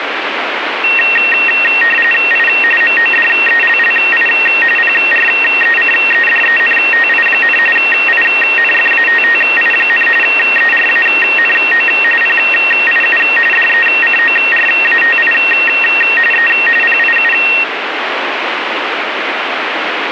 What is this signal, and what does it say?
RTTY (45.45 baud, 850 Hz shift), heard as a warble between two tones, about 2300 Hz centre, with radio static. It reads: I MODELLI PRECEDENTI, INFATTI, ERANO PIU DECORATI E PIU